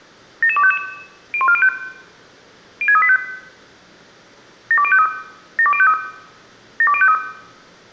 Five-tone selective call (ZVEI), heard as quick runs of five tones, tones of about 70 ms, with room echo. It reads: 77255 01405 06385 72053 72053 72053